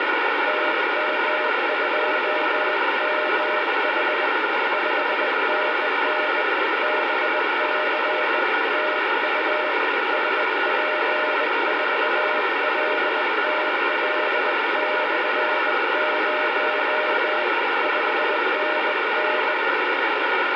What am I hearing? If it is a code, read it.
Morse code, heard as a keyed tone, hand-sent with a bug key, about 20 wpm, 610 Hz, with heavy radio static. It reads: TM2MH 5NN BC TU SP4LTL/0 5NN